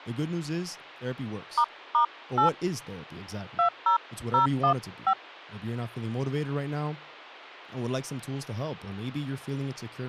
DTMF, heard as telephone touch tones, dialled by hand, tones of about 90 ms, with speech in English. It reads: **8 20015